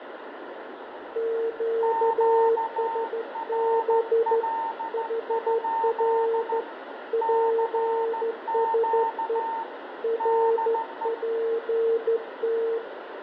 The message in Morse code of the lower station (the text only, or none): QSB HR PSE RPT